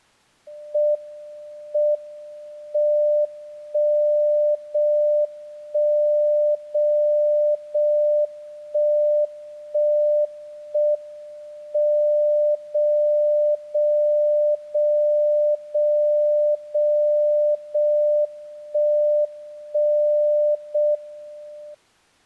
Radio time signal (JJY), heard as a tone whose level steps once a second, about 600 Hz. The time is 06:57 Japan time. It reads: M M 1 0 1 0 0 1 1 1 M 0 0 0 0 0 0 1 1 0 M